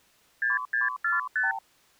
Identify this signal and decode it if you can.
Multi-frequency trunk signalling (R2, with the far end's replies), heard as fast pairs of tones, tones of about 160 ms. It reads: 6645